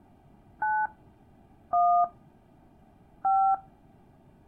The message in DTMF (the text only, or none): 9 1 5